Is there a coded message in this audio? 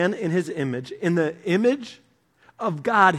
No, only speech in English.